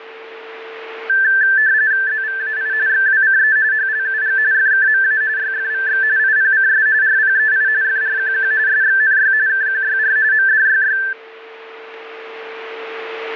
RTTY (45.45 baud, 170 Hz shift), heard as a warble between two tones, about 1650 Hz centre, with a steady whistle near 450 Hz. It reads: ZVAI XWCE HLUG FKMA YFVX IPCS RPEI FRQQ SXNY KQYR MDYY